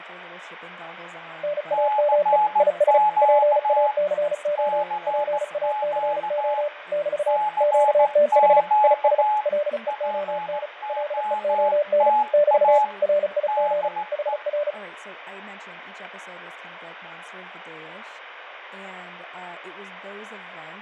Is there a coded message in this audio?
Yes: Morse code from 1.4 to 14.8 s, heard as two keyed tones, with radio static, fading and speech in English. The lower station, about 35 wpm, 590 Hz: NAME IS PACO PACO <BT> QTH IS LEON LEON <BT> RIG HR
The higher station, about 16 wpm, 850 Hz: CQ CQ CQ POTA DE